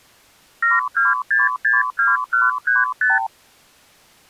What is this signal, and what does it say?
Multi-frequency trunk signalling (R2, with the far end's replies), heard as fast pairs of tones, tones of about 170 ms. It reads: 72662135